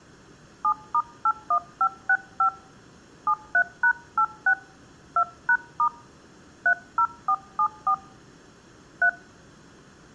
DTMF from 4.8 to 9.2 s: 2#* 30474 3

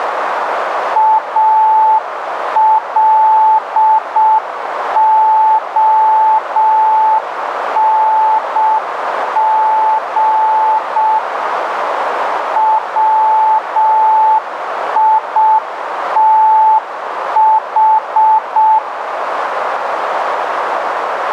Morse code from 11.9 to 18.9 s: WITH

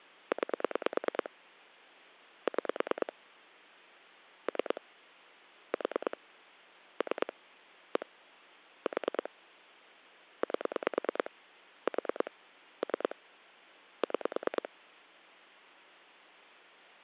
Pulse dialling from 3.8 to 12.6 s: 3 4 3 1 4 8 4

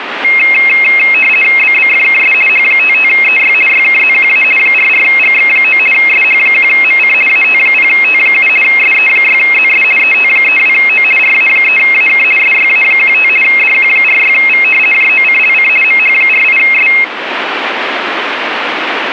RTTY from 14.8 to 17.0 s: JOCLC MH48S

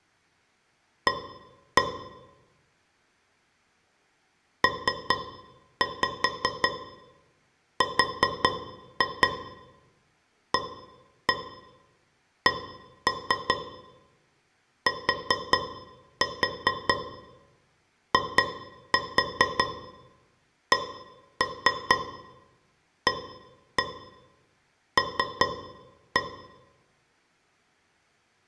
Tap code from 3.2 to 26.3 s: PRACTICAL

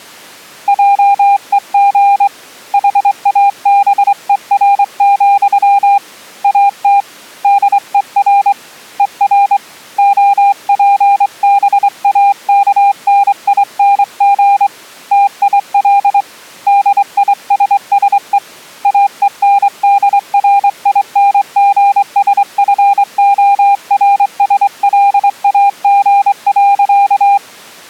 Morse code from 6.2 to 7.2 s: AT

